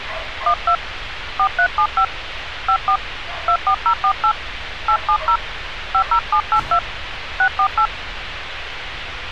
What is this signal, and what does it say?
DTMF, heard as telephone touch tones, dialled by hand, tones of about 80 ms, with radio hiss and street noise. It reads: 12 4375 54 24048 870 50782 648